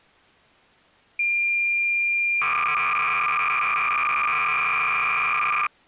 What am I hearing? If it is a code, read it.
Cassette data (Kansas City type), 300 baud, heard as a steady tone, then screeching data.